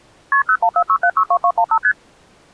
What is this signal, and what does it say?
Multi-frequency trunk signalling (R1, as on North American trunks), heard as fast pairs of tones, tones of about 70 ms. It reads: KP 0146762215 ST